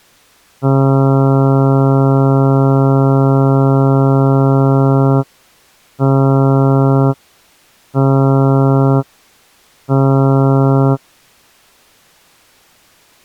Ship horn signal, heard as a ship's horn, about 140 Hz. 1 long, 3 short. At sea: a vessel under tow in fog.